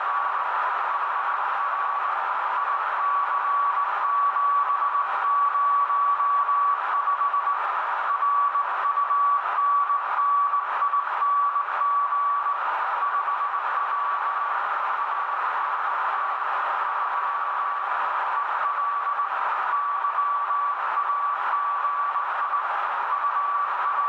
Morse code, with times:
0.0-0.4 …
0.9-2.1 HR
2.6-7.5 IC705
8.1-12.5 RUNNING
13.0-14.5 5W
15.0-16.4 ANT
16.9-17.8 3
18.4-19.2 EL
19.7-22.6 YAGI
23.1-24.1 …

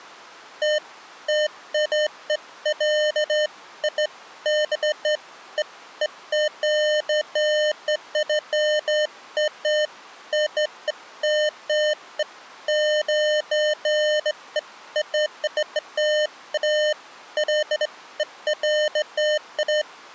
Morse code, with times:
none

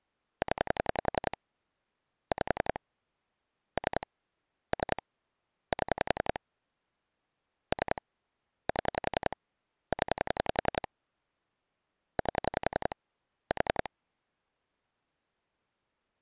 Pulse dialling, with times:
0.4-1.4 0
2.3-2.8 5
3.8-4.1 3
4.7-5.0 3
5.7-6.4 7
7.7-8.0 3
8.7-9.4 7
9.9-10.9 0
12.2-12.9 8
13.5-13.9 4

